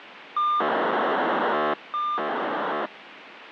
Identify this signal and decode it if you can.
POCSAG pager data (2400 baud), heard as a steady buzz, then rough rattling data, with radio hiss.